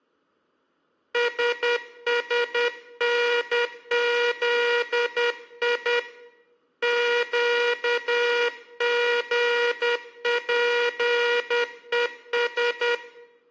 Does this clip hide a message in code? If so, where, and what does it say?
Yes: Morse code (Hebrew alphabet) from 1.1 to 13.0 s, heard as a buzzer, hand-sent with a paddle, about 10 wpm, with room echo. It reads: ששנזי קגפוש